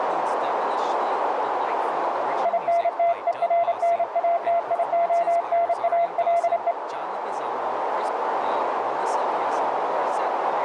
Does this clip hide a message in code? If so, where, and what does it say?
Yes: Morse code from 2.4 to 6.8 s, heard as a keyed tone, hand-sent with a paddle, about 29 wpm, 680 Hz, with radio static, a narrow filter and speech in English. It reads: INTERNATIONALE